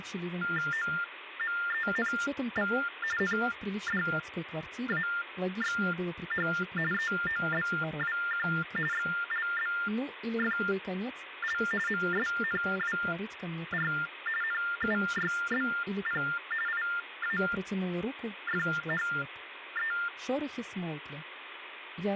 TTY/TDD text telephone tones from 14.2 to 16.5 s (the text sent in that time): NUYBP